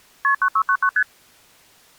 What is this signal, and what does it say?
Multi-frequency trunk signalling (R1, as on North American trunks), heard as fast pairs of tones, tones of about 70 ms. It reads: KP 9699 ST